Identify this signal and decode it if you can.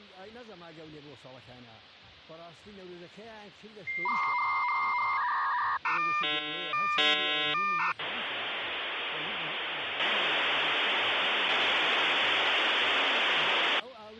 Dial-up modem handshake (V.34 or later), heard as a whistle, warbles, then hiss.